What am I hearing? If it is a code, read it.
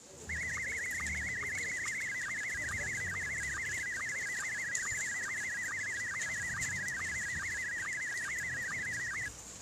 SSTV (slow-scan television), Scottie S1, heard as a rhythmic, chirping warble, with the noise of a residential street.